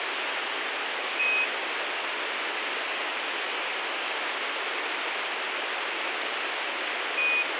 Quindar tones, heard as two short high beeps, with radio hiss.